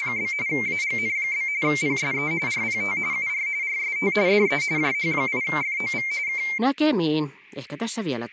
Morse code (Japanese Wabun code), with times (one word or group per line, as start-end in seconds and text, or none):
none